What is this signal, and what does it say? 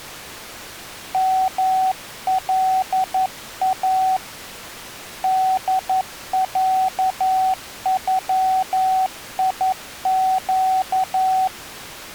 Morse code (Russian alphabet), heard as a keyed tone, hand-sent with a paddle, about 11 wpm, 760 Hz. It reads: МЛА ДЯЮИЩ